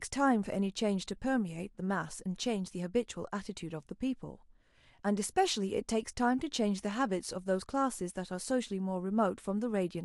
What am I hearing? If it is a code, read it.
Speech in English. There is no code.